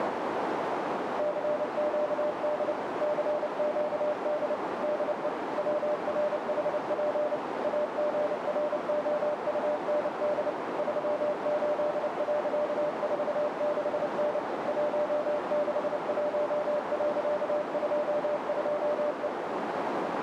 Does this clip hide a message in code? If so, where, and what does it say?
Yes: Morse code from 1.1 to 19.3 s, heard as a keyed tone, machine-sent, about 29 wpm, 600 Hz, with heavy radio static and a narrow filter. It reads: CQD CQD DE WRHP AGROUND 38.46N 161.22E